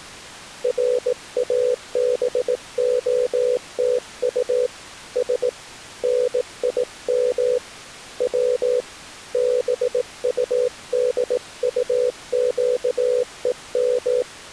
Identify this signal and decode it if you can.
Morse code (Russian alphabet), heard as a keyed tone, hand-sent with a bug key, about 18 wpm, 500 Hz. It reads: РАБОТУ С НИМ В БУДУЩЕМ